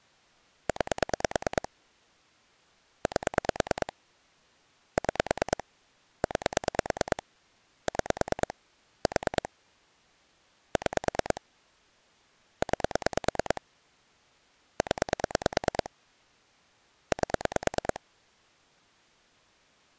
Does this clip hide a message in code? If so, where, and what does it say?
Yes: pulse dialling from 0.7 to 18.0 s, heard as clicks on a phone line, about 9 pulses a second. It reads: 9 8 6 9 6 4 6 9 0 8